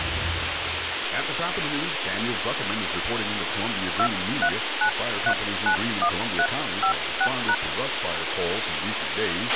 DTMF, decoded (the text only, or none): 239391356#